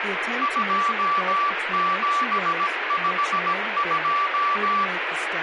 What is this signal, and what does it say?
Morse code, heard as a keyed tone, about 17 wpm, 1160 Hz, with radio static and speech in English. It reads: 2752